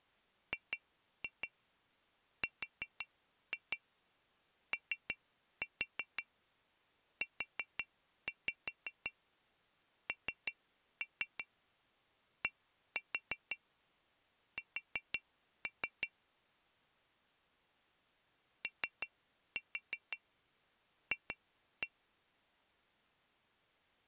Tap code, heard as taps on glass, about 5 knocks a second. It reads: GROUNDS OF